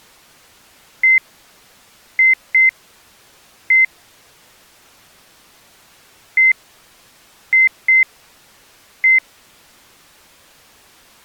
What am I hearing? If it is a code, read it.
Beep code, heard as beeps, played twice, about 2050 Hz. 1-2-1. In Phoenix BIOS tables: interval timer failure.